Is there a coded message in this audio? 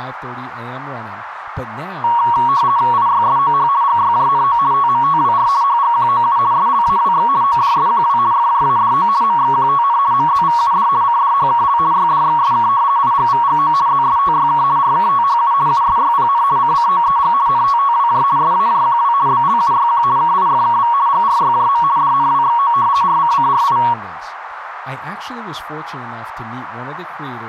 Yes: RTTY (50 baud, 170 Hz shift) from 2.0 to 23.9 s, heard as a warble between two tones, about 1030 Hz centre, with radio static, a narrow filter and speech in English. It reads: IYSOH GYJNO TMTWR HGQOU SLAWX ODSQW FJADO MXQTN MZVUD CDHKL YDXSK IGVGO ZSTYK RKTHU USYPN CCOEG NTTWJ SAJQW BLUYQ KIFKV GRYJM DNWXO RCCRI